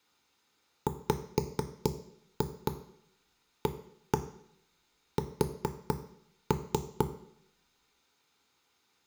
Tap code, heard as knocks on wood, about 4 knocks a second, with room echo. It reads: WAS